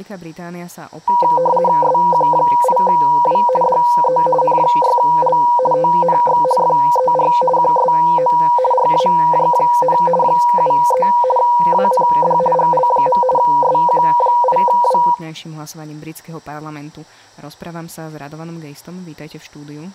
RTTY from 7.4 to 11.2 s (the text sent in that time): QSO RAJ, 73